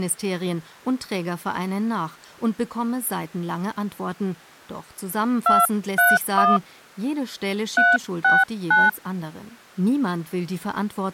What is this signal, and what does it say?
DTMF, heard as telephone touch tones, dialled by hand, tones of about 190 ms, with speech in German. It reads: 231 369